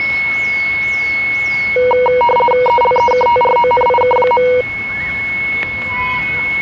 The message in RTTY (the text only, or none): ELEKTRONIK.